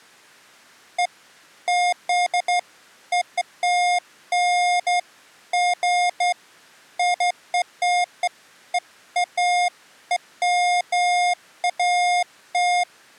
Beeps of irregular length. There is no code.